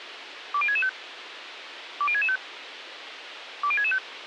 Five-tone selective call (ZVEI), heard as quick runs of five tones, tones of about 70 ms, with radio hiss. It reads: 20665 20665 20665